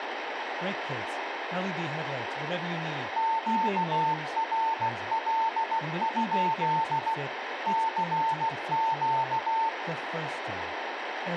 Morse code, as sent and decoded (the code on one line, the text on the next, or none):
--.- .-. .-.. ..--.. / -.-. --.-
QRL? CQ